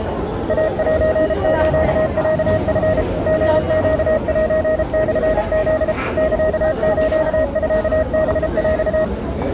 Morse code (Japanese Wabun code), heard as a keyed tone, machine-sent, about 33 wpm, 630 Hz, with the noise of a crowd indoors. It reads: イセスロチ リネセモフ サスミハヰ